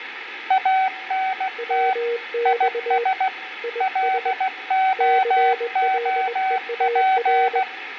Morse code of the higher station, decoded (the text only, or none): ANT IS LOOP